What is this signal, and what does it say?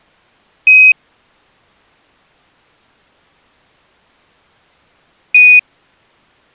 Quindar tones, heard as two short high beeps.